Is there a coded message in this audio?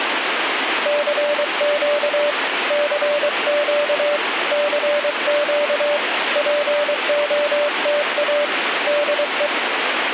Yes: Morse code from 0.8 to 9.5 s, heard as a keyed tone, hand-sent with a paddle, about 23 wpm, 590 Hz, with radio static. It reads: CQ CQ CQ POTA DE